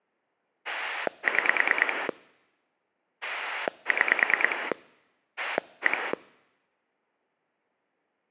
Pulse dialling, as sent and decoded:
6 / 6 / 1
6 6 1

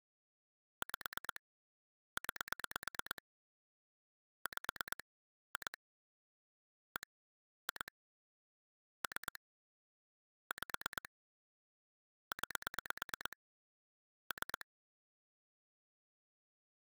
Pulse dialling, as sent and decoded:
5 / 9 / 5 / 2 / 1 / 2 / 3 / 5 / 9 / 3
5 9 5 2 1 2 3 5 9 3

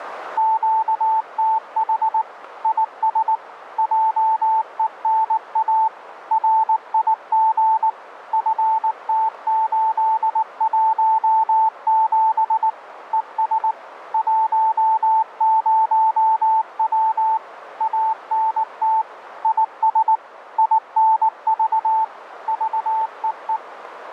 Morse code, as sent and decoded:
--.- - .... / .. ... / .--- . -. .- / .-. .. --. / ..-. - ---.. .---- --... / . ... / .---- ----- .-- / .- -. - / .. ... / .. -. ...- / ...- . .
QTH IS JENA RIG FT817 ES 10W ANT IS INV VEE

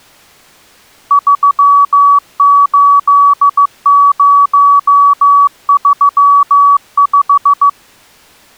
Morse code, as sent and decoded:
...-- ---.. ----- ...-- .....
38035

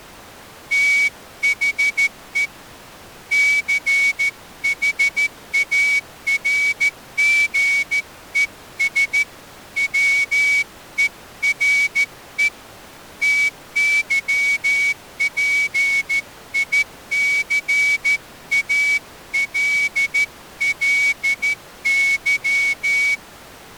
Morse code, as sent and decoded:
- .... . / -.-. .... .- .-. --. . ... / .-- . .-. . / - -.-- .--. .. -.-. .- .-.. .-.. -.--
THE CHARGES WERE TYPICALLY

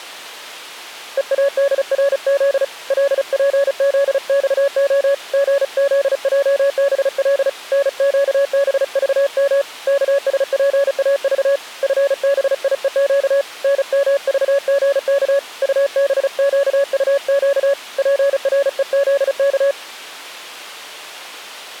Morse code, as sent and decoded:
. .- -.. .-. --.. / .-.. .--. --.. -..- --- / --. --.. .--- -... .-.. / -. --.- -... ...- -- / -.- ... .--. .- ...- / ..-. -... .. . --.- / -. -- ...- --. -.- / ..- -... --.- ..- --.- / .--. .-. . --.. -.-
EADRZ LPZXO GZJBL NQBVM KSPAV FBIEQ NMVGK UBQUQ PREZK

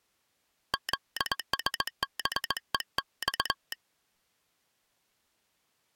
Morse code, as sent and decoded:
--.. ... -... . -..-
ZSBEX

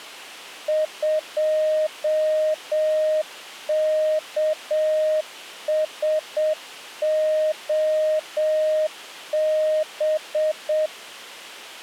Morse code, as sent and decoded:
..--- -.- ... --- -...
2KSOB

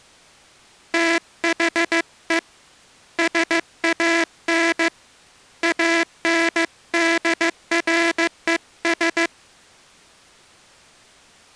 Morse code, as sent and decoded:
- .... . / ... .- -. / .- -. -.. .-. . ...
THE SAN ANDRES

